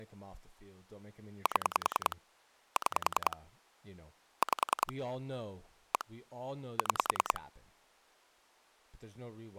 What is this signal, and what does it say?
Pulse dialling, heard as clicks on a phone line, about 10 pulses a second, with speech in English. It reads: 7 6 5 1 6